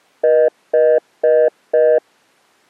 Telephone call progress tone (North American plan), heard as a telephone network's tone, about 480, 620 Hz, 0.25 s on and 0.25 s off. Congestion tone.